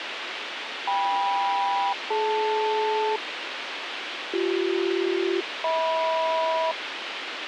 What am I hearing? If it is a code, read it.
Aircraft SELCAL, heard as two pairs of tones, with radio hiss. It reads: KM-DL BC-HM